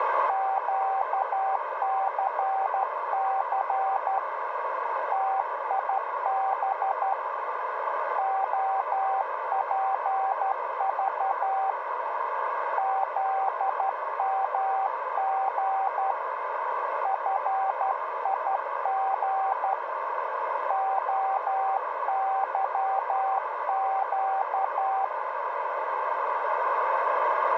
Morse code, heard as a keyed tone, hand-sent with a straight key, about 12 wpm, 780 Hz, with radio static and room echo. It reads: QCC TIB OPV ZMG FIG OYQ